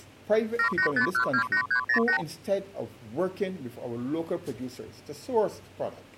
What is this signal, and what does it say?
Multi-frequency trunk signalling (R2, with the far end's replies), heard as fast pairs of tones, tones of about 90 ms. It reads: 785128308